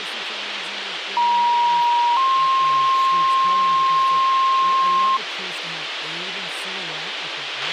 Two-tone page, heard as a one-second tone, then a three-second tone, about 950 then 1060 Hz, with radio hiss, a squelch burst at the end and speech in English.